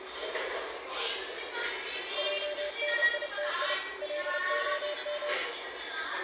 Morse code (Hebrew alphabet), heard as a keyed tone, machine-sent, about 30 wpm, 590 Hz, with radio static and the noise of a crowd indoors. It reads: עניתי להם